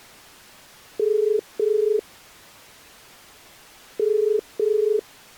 Telephone call progress tone (as in the UK, Ireland, Australia and similar networks), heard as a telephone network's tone, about 430 Hz. Ringback tone.